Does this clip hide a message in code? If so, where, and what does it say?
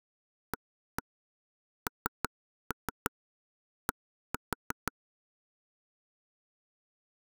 Yes: tap code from 0.5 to 4.9 s, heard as taps on a table, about 6 knocks a second. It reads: AND